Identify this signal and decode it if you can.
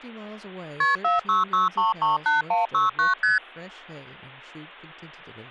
Multi-frequency trunk signalling (R1, as on North American trunks), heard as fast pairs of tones, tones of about 150 ms, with speech in English. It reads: KP 466338169 ST